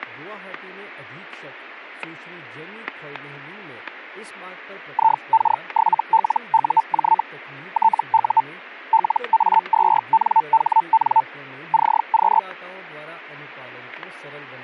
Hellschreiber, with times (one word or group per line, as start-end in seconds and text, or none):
4.9-7.2 IK7LUJ
7.7-8.4 TU
8.9-11.2 LA2NHN
11.7-12.4 CQ